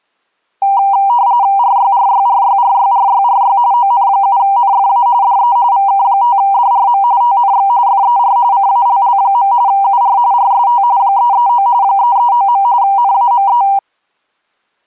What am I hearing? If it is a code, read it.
RTTY (45.45 baud, 170 Hz shift), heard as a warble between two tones, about 880 Hz centre. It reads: RYRYRYRYRYRY ON7NFA DE VK5DRM TNX FER CALL. UR RST 339 339. NAME